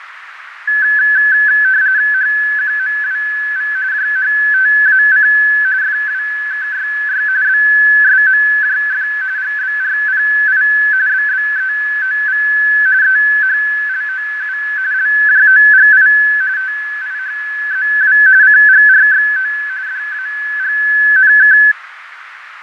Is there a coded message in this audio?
Yes: RTTY (45.45 baud, 170 Hz shift) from 0.7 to 21.7 s, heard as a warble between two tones, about 1600 Hz centre, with radio static, fading and a narrow filter. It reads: HQMWV JHTAC FWKYY BSMJF GBRPI BBEOV EHLOU LJOGI TIHZW CGRXO DAGNK